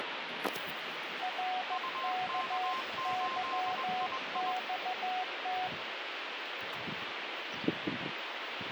Morse code, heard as two keyed tones, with radio static and the noise of a residential street. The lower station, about 15 wpm, 740 Hz: RKYXT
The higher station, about 21 wpm, 1050 Hz: UK8II